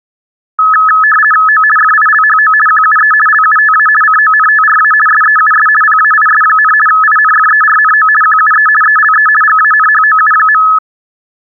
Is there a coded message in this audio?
Yes: RTTY (50 baud, 450 Hz shift) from 0.6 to 10.8 s, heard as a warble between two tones, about 1500 Hz centre. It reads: O FILHO QUE LUTA CONTRA SEUS PAIS, INFERNO QUE ELE GANHOU.